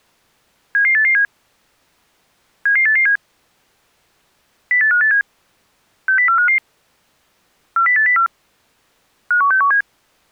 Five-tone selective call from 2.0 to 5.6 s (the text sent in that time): 77887 08587